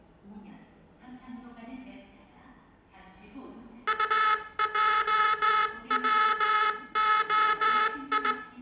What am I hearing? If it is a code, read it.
Morse code, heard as a buzzer, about 18 wpm, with room echo and the noise of a subway station. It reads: UJWOI